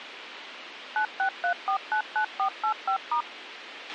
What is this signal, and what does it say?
DTMF, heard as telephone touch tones, dialled by machine, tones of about 90 ms, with radio hiss and a squelch burst at the end. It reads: 963499485*